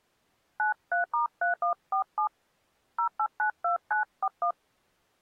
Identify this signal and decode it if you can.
DTMF, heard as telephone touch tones, dialled by hand, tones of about 90 ms. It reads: 93*3147 0892941